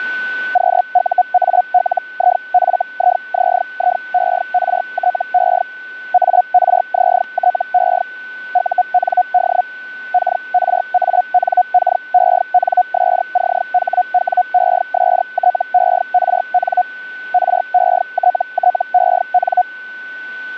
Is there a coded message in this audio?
Yes: Hellschreiber (Feld-Hell, 122.5 baud) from 0.5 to 19.6 s, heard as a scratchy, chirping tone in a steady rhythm, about 720 Hz, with a steady whistle near 1500 Hz. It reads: QUALIFIZIERTE ARZTE UND KRANKENSCHWESTERN RETTEN